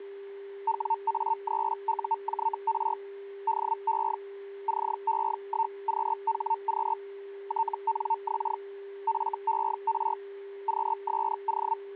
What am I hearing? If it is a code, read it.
Hellschreiber (Feld-Hell, 122.5 baud), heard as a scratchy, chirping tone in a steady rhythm, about 900 Hz, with a steady whistle near 400 Hz. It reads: WA3UJR DE CE1QHQ TNX FER QSO